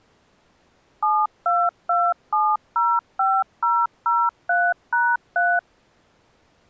DTMF, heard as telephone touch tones, dialled by machine, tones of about 230 ms. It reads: 722705003#3